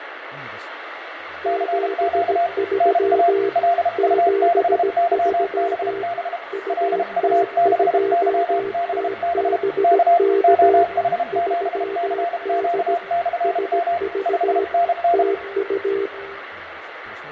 Morse code, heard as two keyed tones, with radio static, fading, room echo and speech in Dutch. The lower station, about 17 wpm, 400 Hz: 73 73 UT2TBK 3D SV TU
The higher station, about 32 wpm, 690 Hz: CQ NA LU6YBB LU6YBB K OH7CQ/M 5NN